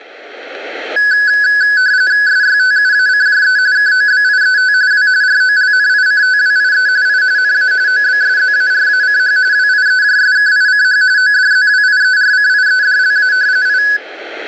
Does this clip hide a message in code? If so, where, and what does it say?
Yes: RTTY (45.45 baud, 170 Hz shift) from 1.0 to 14.0 s, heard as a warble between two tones, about 1600 Hz centre. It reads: SYTUACJE KOBIET W ROLNICTWIE I NA OBSZARACH WIEJSKICH ODZWIERCIEDLA I